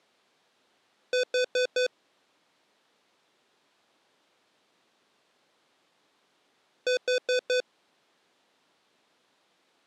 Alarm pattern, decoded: temporal four

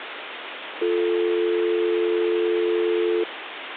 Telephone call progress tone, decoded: dial tone

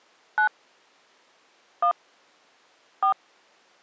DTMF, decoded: 9 1 4

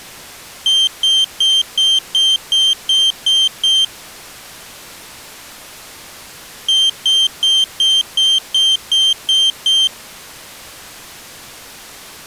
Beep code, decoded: 9 short

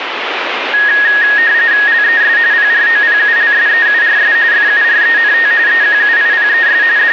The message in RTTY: LES PROPULSEURS FURENT EQUIPES …

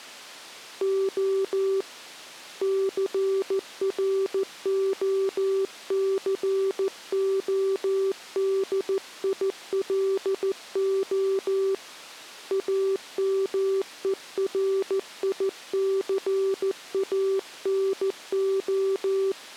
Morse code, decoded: O CROCODILO AMERICANO

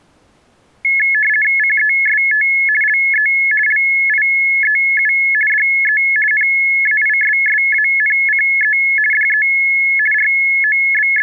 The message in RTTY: CEST LE LIEU DE NAISSANCE DE …

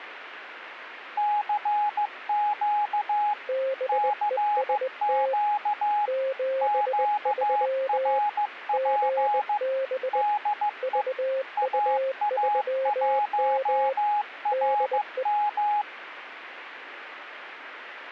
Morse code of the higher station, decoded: CQ CQ QRP DE AA1RM

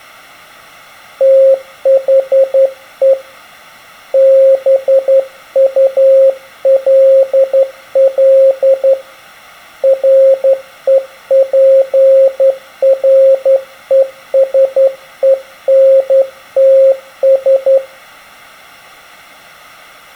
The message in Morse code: THE BULL REPRESENTS

